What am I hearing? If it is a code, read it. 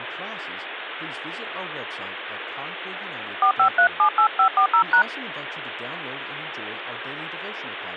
DTMF, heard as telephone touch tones, dialled by hand, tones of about 90 ms, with phone line noise and speech in English. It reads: 45378540#